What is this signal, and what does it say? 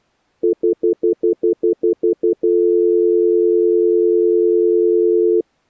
Telephone call progress tone (North American plan), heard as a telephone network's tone, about 350, 440 Hz, 0.1 s on and 0.1 s off. Stutter dial tone.